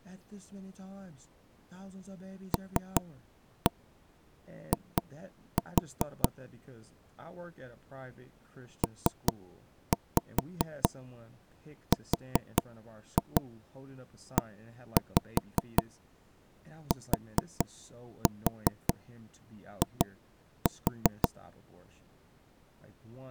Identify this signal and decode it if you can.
Tap code, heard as knocks on wood, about 5 knocks a second, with speech in English. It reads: LI PRETI